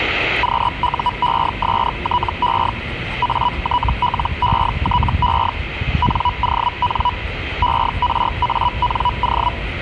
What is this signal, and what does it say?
Hellschreiber (Feld-Hell, 122.5 baud), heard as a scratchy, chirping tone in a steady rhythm, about 980 Hz, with the noise of a residential street. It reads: QUESTE ATLETE NON ERANO